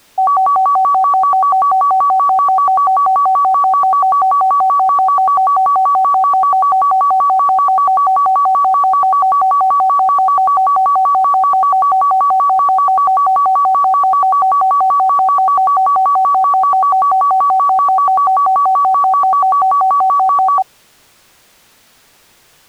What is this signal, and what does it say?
A tone that alternates evenly between two pitches. There is no code.